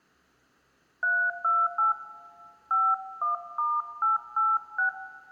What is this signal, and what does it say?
DTMF, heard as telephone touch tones, dialled by hand, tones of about 190 ms, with room echo. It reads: 328 51*886